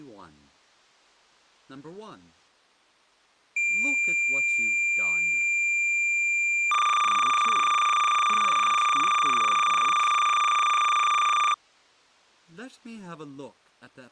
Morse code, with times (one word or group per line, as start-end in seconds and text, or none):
none